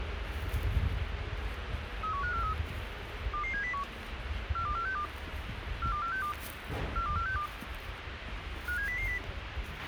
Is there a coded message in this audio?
Yes: five-tone selective call (CCIR) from 2.0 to 9.2 s, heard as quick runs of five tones, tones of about 100 ms, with radio hiss, a squelch burst at the end and the noise of a residential street. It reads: 31543 22701 42462 42462 42462 57000